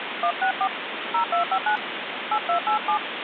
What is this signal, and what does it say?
DTMF, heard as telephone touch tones, dialled by hand, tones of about 90 ms, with phone line noise. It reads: 164 0259 8287